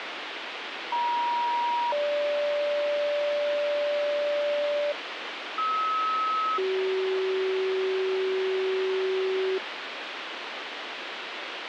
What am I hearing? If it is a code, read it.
Two-tone page, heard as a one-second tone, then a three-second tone, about 950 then 580 Hz, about 1290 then 380 Hz, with radio hiss.